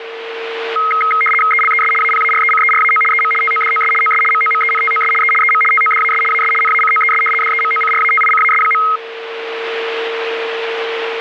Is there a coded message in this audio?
Yes: RTTY (75 baud, 850 Hz shift) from 0.8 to 9.0 s, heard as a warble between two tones, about 1700 Hz centre, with radio static and a steady whistle near 460 Hz. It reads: ELES APARECERAO EM TODOS OS MOMENTOS E EM TODAS AS NACOES DEMOCRATICAS.